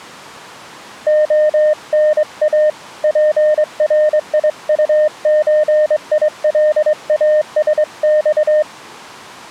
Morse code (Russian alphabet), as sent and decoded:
--- -. .- / .--. .-. .. ..- ---. .. .-.. .- ... -..-
ОНА ПРИУЧИЛАСЬ

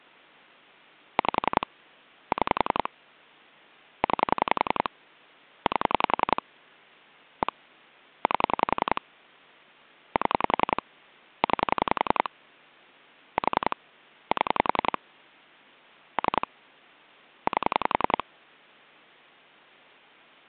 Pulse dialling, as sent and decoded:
5 / 6 / 9 / 8 / 1 / 8 / 7 / 9 / 4 / 7 / 3 / 8
5 6 9 8 1 8 7 9 4 7 3 8

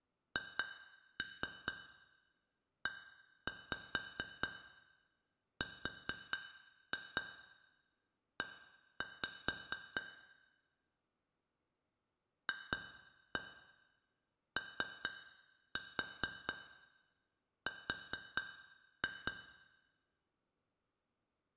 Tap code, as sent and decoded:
2-3 1-5 4-2 1-5 / 2-1 3-4 4-2
HERE FOR

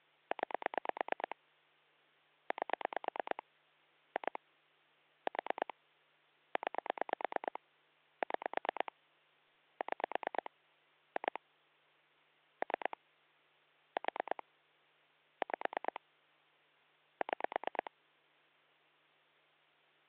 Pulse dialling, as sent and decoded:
9 / 8 / 2 / 4 / 9 / 6 / 6 / 2 / 3 / 4 / 5 / 6
9 8 2 4 9 6 6 2 3 4 5 6

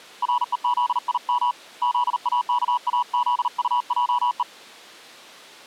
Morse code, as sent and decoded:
.-. . --.. .. -- / --.. .- -.- .- --.. ..- .--- .
REZIM ZAKAZUJE

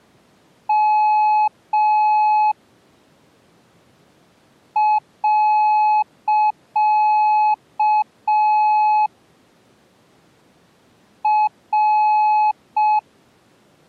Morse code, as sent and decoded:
-- / .-.-.- / .-.
M . R

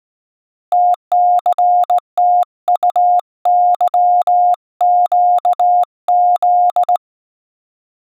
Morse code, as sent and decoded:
- -.-. - ..- -.-- --.- --..
TCTUYQZ

